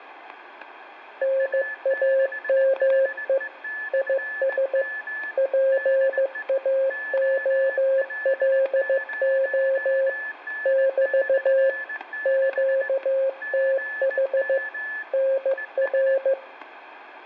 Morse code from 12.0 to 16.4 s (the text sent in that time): QTH NR